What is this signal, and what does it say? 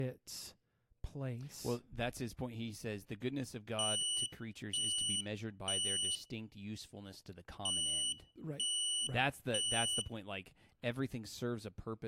Alarm pattern, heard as an alarm's beeps, played twice, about 2950 Hz, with room echo and speech in English. Temporal three. Smoke or fire, evacuate.